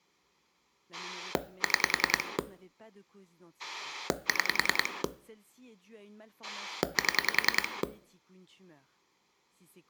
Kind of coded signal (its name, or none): pulse dialling